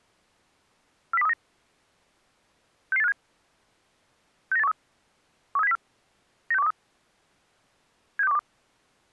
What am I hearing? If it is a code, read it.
Five-tone selective call (EEA), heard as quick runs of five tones, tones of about 40 ms. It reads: 40239 66857 69813 13704 96123 76212